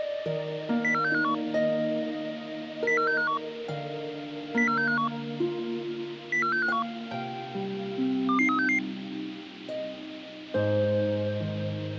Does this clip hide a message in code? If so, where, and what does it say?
Yes: five-tone selective call (CCIR) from 0.8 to 8.8 s, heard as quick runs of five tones, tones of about 100 ms. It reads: 04651 04651 04651 04651 22366